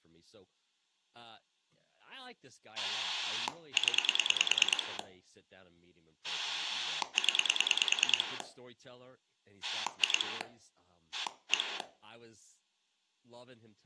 Pulse dialling, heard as a rotary dial, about 9 pulses a second, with room echo and speech in English. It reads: 0 0 2 1